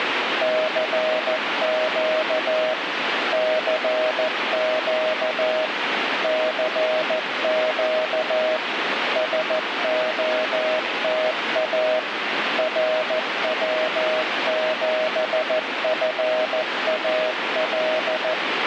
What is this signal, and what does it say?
Morse code, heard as a keyed tone, machine-sent, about 14 wpm, 630 Hz, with radio static. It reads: CQ CQ CQ SOTA RW7FAL